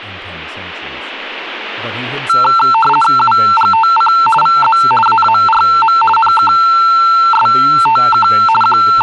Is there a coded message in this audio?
Yes: RTTY (50 baud, 450 Hz shift) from 2.3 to 9.0 s, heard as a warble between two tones, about 1120 Hz centre, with speech in English. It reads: UGTC VZ AARM NKSTK …